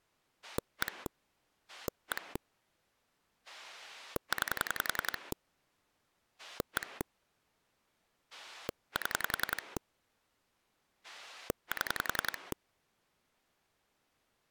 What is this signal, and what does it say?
Pulse dialling, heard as a rotary dial, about 10 pulses a second. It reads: 1 1 9 1 7 7